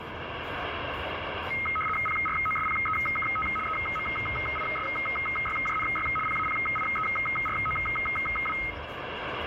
RTTY (75 baud, 850 Hz shift), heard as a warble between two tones, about 1700 Hz centre, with radio static and the noise inside a car. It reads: PROSPEKT EMISYJNY PAPIEROW